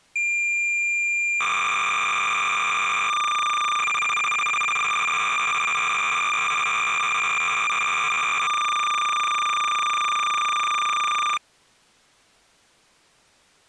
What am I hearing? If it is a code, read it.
Cassette data (Kansas City type), 300 baud, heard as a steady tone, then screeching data.